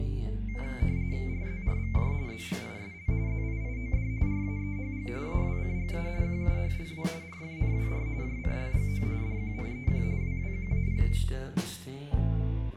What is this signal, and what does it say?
RTTY (45.45 baud, 170 Hz shift), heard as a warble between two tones, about 2200 Hz centre, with room echo. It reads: RZRVJ ZGISL ZIIOD RAEHG AWCGA QUHLW RFNWR JCLGO DQNEQ WWQAP